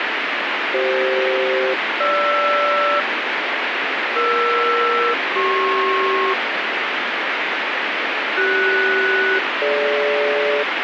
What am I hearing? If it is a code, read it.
Aircraft SELCAL, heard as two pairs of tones, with heavy radio static. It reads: CF-GR ER-CP CS-DG